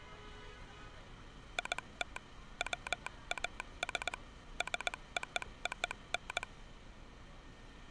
Morse code (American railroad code), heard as a telegraph sounder, hand-sent with a straight key, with street noise. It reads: IT WAS SOON